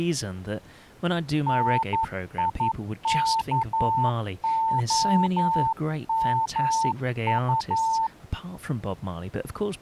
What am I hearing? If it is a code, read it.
Morse code, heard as a keyed tone, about 11 wpm, 900 Hz, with speech in English. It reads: NIKOMU